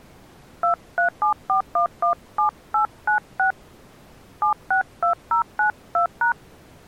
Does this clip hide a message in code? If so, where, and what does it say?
Yes: DTMF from 0.6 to 6.3 s, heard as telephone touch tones, dialled by hand, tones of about 110 ms. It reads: 2374117896 762092#